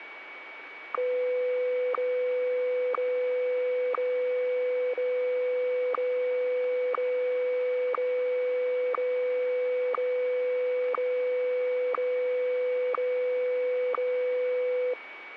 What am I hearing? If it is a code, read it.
Radio time signal (WWVH, Hawaii), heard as ticks, one a second, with radio static and a steady whistle near 2260 Hz.